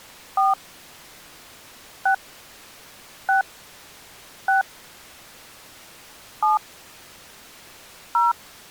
DTMF, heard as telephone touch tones, dialled by hand, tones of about 130 ms. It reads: 4 6 6 6 7 0